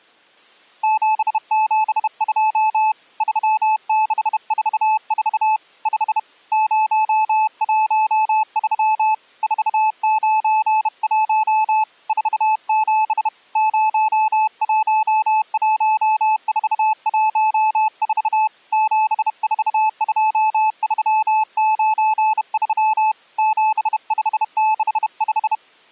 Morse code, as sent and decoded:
--... --... ..--- / ...-- -.... ....- ....- / ..... / ----- .---- ...-- / ....- ----. .---- / ....- --... / ----- .---- .---- ....- .---- ....- / --... ....- ..--- ...-- ----. ...-- / --... ..... -.... .....
772 3644 5 013 491 47 011414 742393 7565

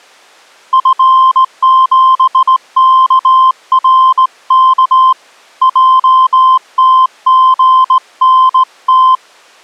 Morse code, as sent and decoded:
..-. --... -.- .-. -.- / .--- - --. -. -
F7KRK JTGNT

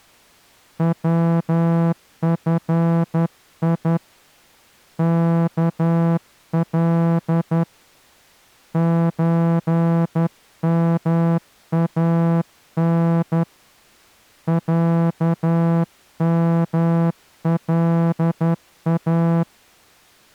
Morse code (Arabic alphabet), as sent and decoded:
.-- ..-. .. / -.- .-.. / ---. -- .- -. / .-.- -- .-.. .-
وفي كل زمان عملا

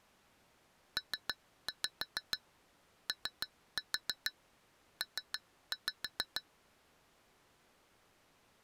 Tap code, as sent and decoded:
3-5 3-4 3-5
POP

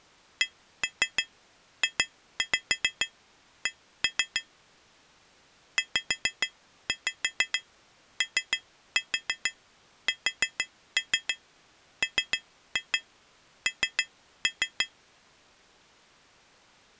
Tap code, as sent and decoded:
1-3 2-5 1-3 / 5-5 3-4 4-3 3-2 3-3
CJC ZOSMN

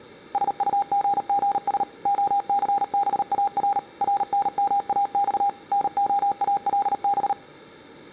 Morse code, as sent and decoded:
... ..- --. --. ... / --- -.-. -... .- .-. / .-. -. -- .- -..- / -. --- .- .-.. -...
SUGGS OCBAR RNMAX NOALB

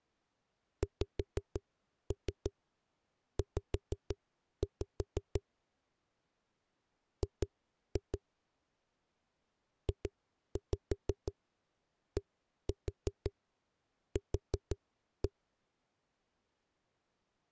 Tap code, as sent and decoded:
5-3 5-5 / 2-2 / 2-5 1-4 4-1
XZ G JDQ

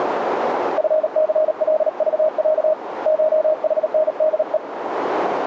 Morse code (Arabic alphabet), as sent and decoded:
..-. -.-. .-.. ...- .-.- / ---- .... -. -.. .
فثلضع شحندء

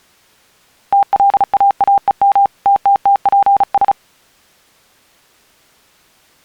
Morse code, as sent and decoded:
- .-.. .- .- . -- / - - - .--. ...
TLAAEM TTTPS

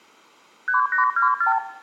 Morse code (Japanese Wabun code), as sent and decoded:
none

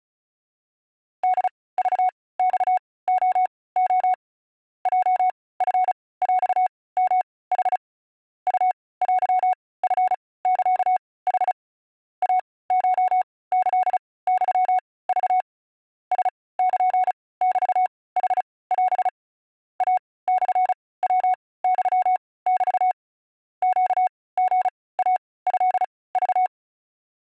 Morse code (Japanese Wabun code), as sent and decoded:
-.. ...- -..- --- --- / .--- ..-. .-..- -- .... / ..- .-.-- ..-. -.-.- .... / .- ---- -.-.. -..-- ...- / ... -.--. -...- .... .-... / .- -..-. .-- -..-- -...- / --.- --. .- ..-.. ...-
ホクマレレ ヲチヰヨヌ ウテチサヌ イコキユク ラルメヌオ イモヤユメ ネリイトク

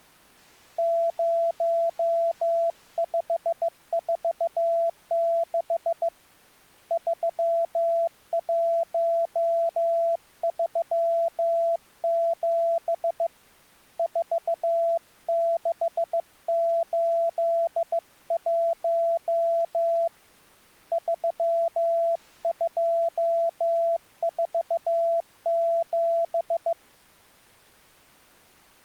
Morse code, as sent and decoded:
----- ..... ....- -.... / ...-- .---- ...-- --... / ....- -.... ---.. .---- / ...-- ..--- ....- --...
0546 3137 4681 3247

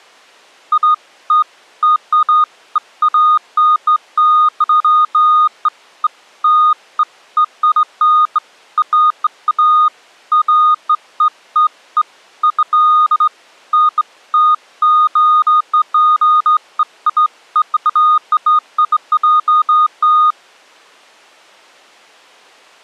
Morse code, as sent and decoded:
none

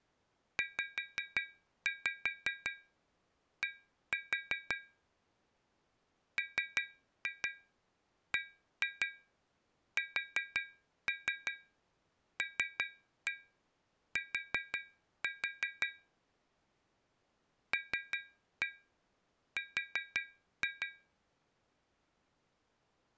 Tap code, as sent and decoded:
5-5 1-4 / 3-2 1-2 4-3 3-1 4-4 / 3-1 4-2
ZD MBSLT LR

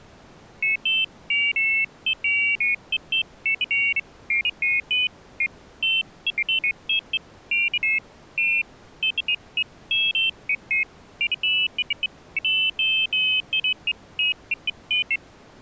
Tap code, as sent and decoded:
none

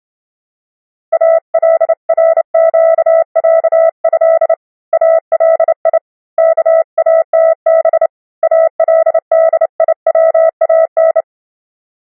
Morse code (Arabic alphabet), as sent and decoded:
.- .-.. .-. --.- .-.- ..-.. / .- .-.. .. / -.- .- - -... / .- .-.. -.. .. .-- .- -.
الرقعه الي كاتب الديوان

